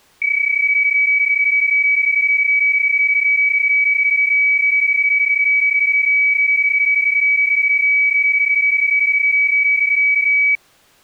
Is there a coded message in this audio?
Yes: PSK31 (31.25 baud) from 0.2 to 10.6 s, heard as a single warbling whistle, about 2300 Hz.